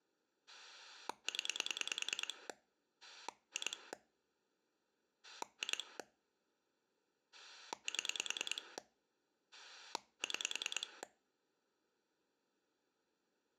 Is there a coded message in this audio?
Yes: pulse dialling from 0.5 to 11.0 s, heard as a rotary dial, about 10 pulses a second. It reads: 0 2 2 7 6